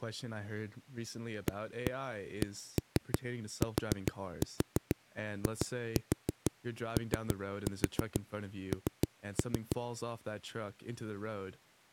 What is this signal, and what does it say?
Tap code, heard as knocks on a wall, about 6 knocks a second, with speech in English. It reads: ACTION